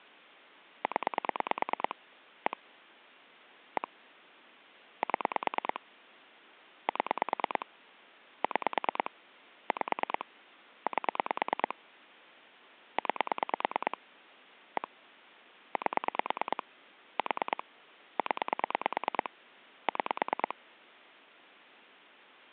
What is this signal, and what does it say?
Pulse dialling, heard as clicks on a phone line, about 9 pulses a second. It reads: 0 1 1 7 7 6 5 8 9 1 8 4 0 6